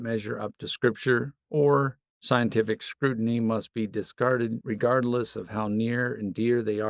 Speech in English. There is no code.